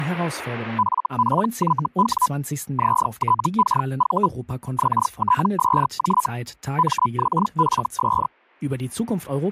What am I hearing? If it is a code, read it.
Hellschreiber (Feld-Hell, 122.5 baud), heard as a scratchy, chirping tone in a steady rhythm, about 1000 Hz, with speech in German. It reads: FPYW ZTKV XTSJ MXFS